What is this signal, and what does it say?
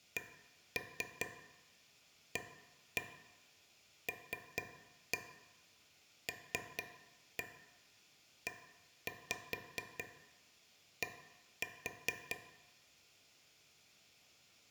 Tap code, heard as taps on a table, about 4 knocks a second, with room echo. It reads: CALLED